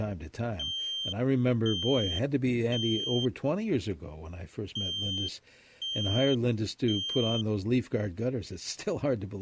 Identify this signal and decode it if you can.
Alarm pattern, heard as an alarm's beeps, played twice, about 3150 Hz, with speech in English. Temporal three. Smoke or fire, evacuate.